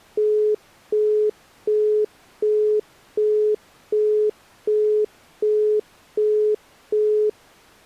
Telephone call progress tone (as in the UK, Australia and similar networks), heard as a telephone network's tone, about 420 Hz, 0.375 s on and 0.375 s off. Busy tone.